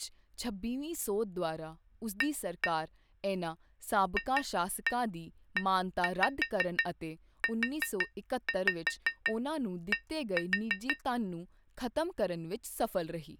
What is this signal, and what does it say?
Tap code, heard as taps on glass, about 5 knocks a second, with speech in Punjabi. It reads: A FEUD